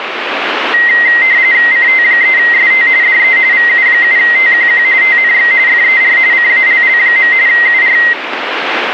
RTTY (45.45 baud, 170 Hz shift), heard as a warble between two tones, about 2000 Hz centre, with radio static. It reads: CT3ST DE VU7TQQ TNX FER CALL. UR